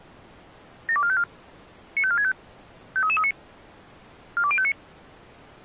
Five-tone selective call (ZVEI), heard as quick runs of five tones, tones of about 70 ms. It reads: 72454 95465 53339 42059